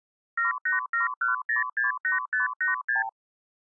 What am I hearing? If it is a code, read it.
Multi-frequency trunk signalling (R2, with the far end's replies), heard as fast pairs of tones, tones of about 140 ms. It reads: 7871068586